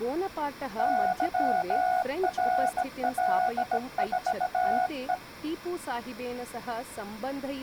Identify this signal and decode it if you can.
Morse code, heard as a keyed tone, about 17 wpm, 730 Hz, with speech in Sanskrit. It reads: YRL4E